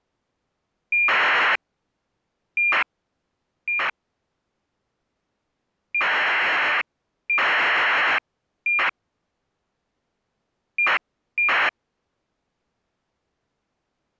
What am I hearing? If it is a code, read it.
ACARS aircraft data, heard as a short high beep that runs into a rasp, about 2400 baud.